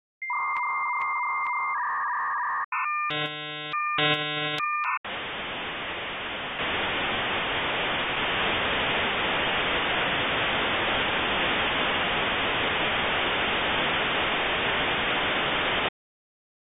Dial-up modem handshake (V.34 or later), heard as a whistle, warbles, then hiss.